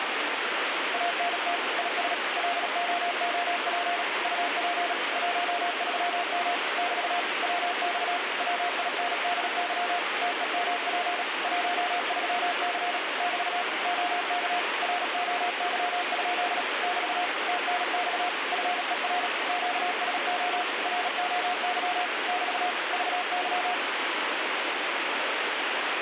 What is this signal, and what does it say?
Morse code, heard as a keyed tone, machine-sent, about 37 wpm, 710 Hz, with heavy radio static. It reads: ANT IS LOOP UP 13M <BT> WX WINDY TEMP 13C <BT> OK ROY? <BT> TNX FER QSO ROY <BT> VY